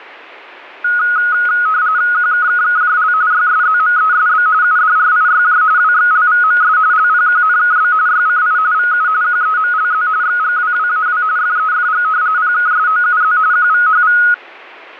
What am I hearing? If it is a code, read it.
RTTY (45.45 baud, 170 Hz shift), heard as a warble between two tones, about 1360 Hz centre, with static crashes. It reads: QKKKJL YSZMESB UDRIYJ WXLVMS LPQNKB YCI VU QEMLZ XGWWAW FEFG PKSOUZ QVHV